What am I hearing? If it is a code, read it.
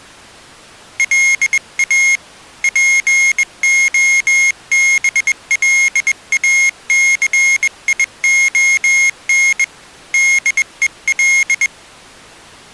Morse code, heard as a high beeper, hand-sent with a bug key, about 21 wpm, 2150 Hz. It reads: LA POBLACION DEL